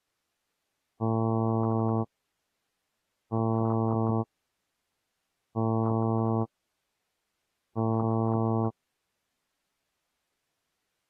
Ship horn signal, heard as a ship's horn, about 110 Hz. 4 short. At sea: a pilot vessel's identity signal in fog.